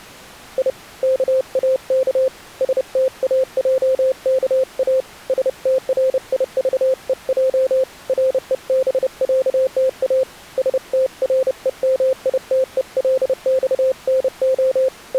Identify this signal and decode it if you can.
Morse code (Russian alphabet), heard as a keyed tone, hand-sent with a paddle, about 30 wpm, 520 Hz. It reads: И КАК СТАЙКА СТРИЖЕЙ РЕБЯТА СТРЕМИТЕЛЬНО …